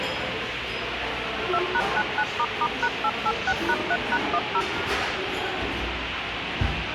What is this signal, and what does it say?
DTMF, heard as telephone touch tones, dialled by machine, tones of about 60 ms, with radio hiss and the noise of a restaurant. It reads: 2#99**#886#3#10